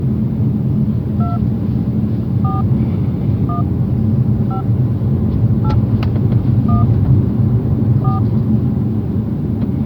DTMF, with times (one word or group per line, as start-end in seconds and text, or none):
1.2-1.4 2
2.4-2.6 4
3.5-3.6 1
4.5-4.6 5
5.6-5.7 8
6.7-6.8 1
8.0-8.2 4